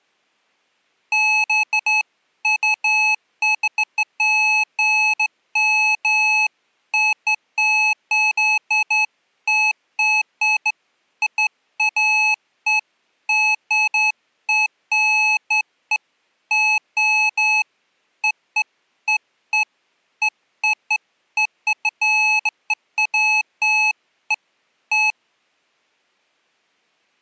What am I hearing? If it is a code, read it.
Beeps of irregular length. There is no code.